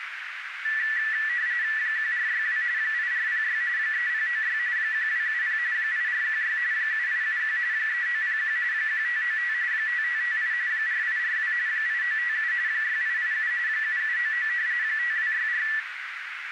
RTTY (45.45 baud, 170 Hz shift), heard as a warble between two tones, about 1850 Hz centre, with radio static and a narrow filter. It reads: 1462 8406 3096 1270 8416 7871 3901 1595 5558 4842 8957 6887 7799 5264